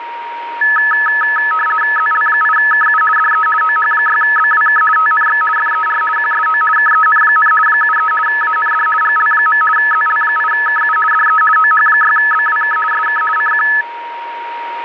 RTTY (50 baud, 450 Hz shift), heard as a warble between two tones, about 1500 Hz centre, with radio static and a steady whistle near 940 Hz. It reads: ZL8KU DE OH6BWK TNX FER QSO KEN, 73 AND GL. ZL8KU DE OH6BWK SK CQ